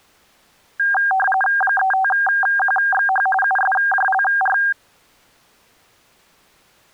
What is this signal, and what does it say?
RTTY (45.45 baud, 850 Hz shift), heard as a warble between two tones, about 1190 Hz centre. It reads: 35QXH USJLR